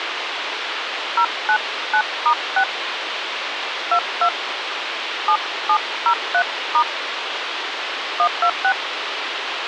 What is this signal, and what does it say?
DTMF, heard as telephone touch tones, dialled by hand, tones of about 80 ms, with radio hiss. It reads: 099*6 22 7703* 126